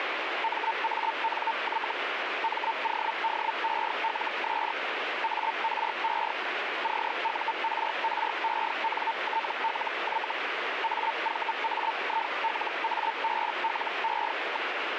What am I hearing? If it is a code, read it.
Hellschreiber (Feld-Hell, 122.5 baud), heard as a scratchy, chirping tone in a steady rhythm, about 900 Hz, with radio static. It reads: MANY MODELS ARE CURRENTLY AVAILABLE.